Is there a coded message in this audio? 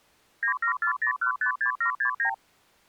Yes: multi-frequency trunk signalling (R2, with the far end's replies) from 0.4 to 2.3 s, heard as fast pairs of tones, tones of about 100 ms. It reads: 9740156769